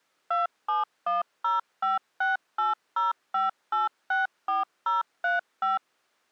DTMF, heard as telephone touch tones, dialled by machine, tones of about 160 ms. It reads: 271056805864035